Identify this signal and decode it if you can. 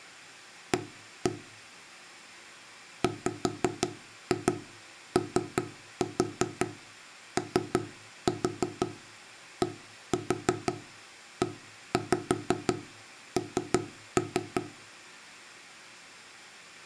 Tap code, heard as knocks on wood, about 5 knocks a second. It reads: A WOODEN